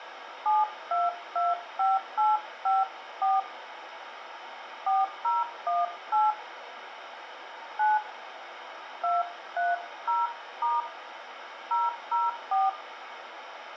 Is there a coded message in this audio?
Yes: DTMF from 0.5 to 12.7 s, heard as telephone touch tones, dialled by hand, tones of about 180 ms, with phone line noise and room echo. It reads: 7225854 4018 9 230* 004